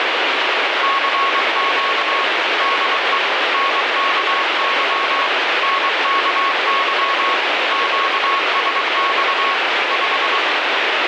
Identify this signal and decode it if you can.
Morse code, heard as a keyed tone, machine-sent, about 23 wpm, 1100 Hz, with heavy radio static. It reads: CQ DE NKY NKY QSX 5